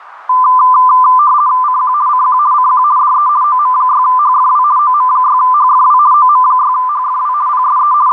RTTY (50 baud, 170 Hz shift), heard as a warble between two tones, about 1100 Hz centre, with radio static. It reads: CQ CQ CQ DE OM6HFW OM6HFW OM6HFW PSE …